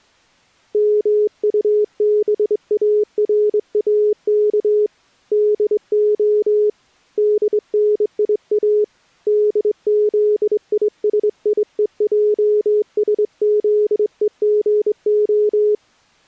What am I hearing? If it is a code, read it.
Morse code, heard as a keyed tone, hand-sent with a straight key, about 23 wpm, 420 Hz. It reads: MUBARAK DO DNIA DZISIEJSZEGO